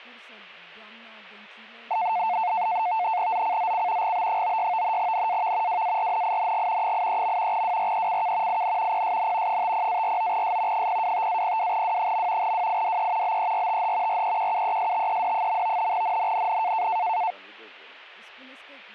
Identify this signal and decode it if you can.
NAVTEX (SITOR-B), 100 baud, 170 Hz shift, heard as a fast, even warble, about 800 Hz centre. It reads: ZCZC GB96 NAV WARNING 83. WRECK IN PSN 50-49S 025-02W. WIDE BERTH REQUESTED. NNNN